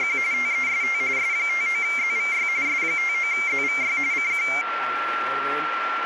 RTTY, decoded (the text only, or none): … TEST S59ZVY S59ZVY CQ